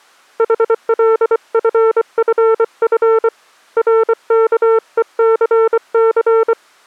Morse code, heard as a keyed tone, hand-sent with a paddle, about 24 wpm, 450 Hz. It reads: HLFFF RKECC